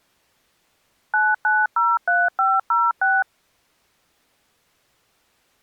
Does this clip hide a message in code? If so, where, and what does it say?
Yes: DTMF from 1.1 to 3.2 s, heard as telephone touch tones, dialled by machine, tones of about 210 ms. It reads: 9903506